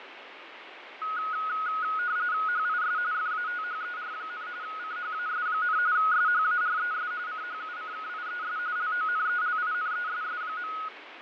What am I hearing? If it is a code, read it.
RTTY (45.45 baud, 170 Hz shift), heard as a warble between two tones, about 1360 Hz centre, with radio static and fading. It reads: HIS FATHER, CHAS, SHARES CHUCKIES LONELINESS.